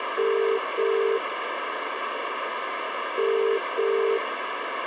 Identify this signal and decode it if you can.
Telephone call progress tone (as in the UK, Ireland, Australia and similar networks), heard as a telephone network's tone, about 400, 450 Hz, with phone line noise. Ringback tone.